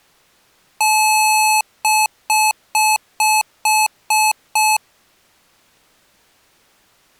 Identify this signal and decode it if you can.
Beep code, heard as beeps from a small speaker, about 860 Hz. 1 long, 7 short.